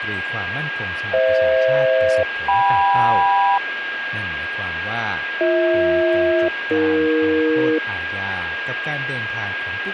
Aircraft SELCAL, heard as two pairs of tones, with radio static and a steady whistle near 1630 Hz. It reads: FH-KM BH-AE